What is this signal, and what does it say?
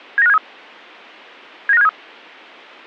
Five-tone selective call (EEA), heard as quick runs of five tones, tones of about 40 ms, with a squelch burst at the end. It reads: 79573 79573